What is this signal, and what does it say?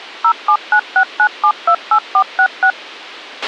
DTMF, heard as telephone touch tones, dialled by machine, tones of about 80 ms, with a squelch burst at the end. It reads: 07969728466